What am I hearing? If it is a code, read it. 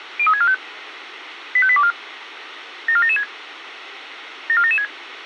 Five-tone selective call (ZVEI), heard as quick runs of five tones, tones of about 70 ms, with radio hiss. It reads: 03645 85824 74776 74776